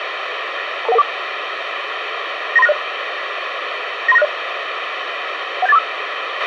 Five-tone selective call (EIA), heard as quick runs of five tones, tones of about 30 ms, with radio hiss and a squelch burst at the end. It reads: 22114 93960 93960 17845